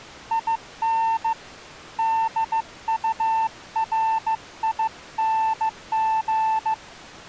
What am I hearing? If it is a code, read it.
Morse code, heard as a keyed tone, hand-sent with a bug key, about 15 wpm, 890 Hz. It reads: IN DURING